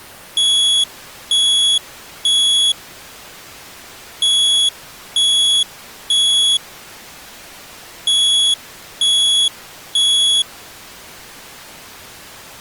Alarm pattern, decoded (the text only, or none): temporal three